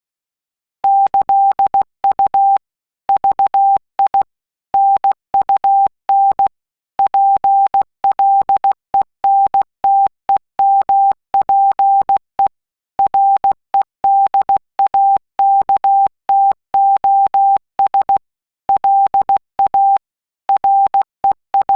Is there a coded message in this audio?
Yes: Morse code (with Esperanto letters) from 0.8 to 21.8 s, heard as a keyed tone, machine-sent, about 16 wpm, 790 Hz. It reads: ĈU VI NUN PLENTEMPE REDAKTOS LA …